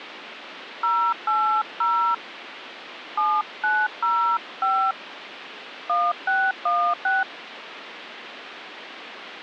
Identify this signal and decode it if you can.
DTMF, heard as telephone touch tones, dialled by hand, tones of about 240 ms, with phone line noise. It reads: 080 7905 1616